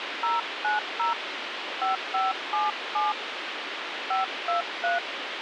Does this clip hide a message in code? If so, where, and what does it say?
Yes: DTMF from 0.2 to 5.0 s, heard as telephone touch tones, dialled by hand, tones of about 190 ms, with radio hiss. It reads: 090 5577 523